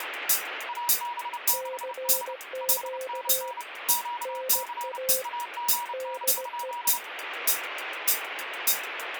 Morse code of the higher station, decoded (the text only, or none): AB6H 5NN QC AGN?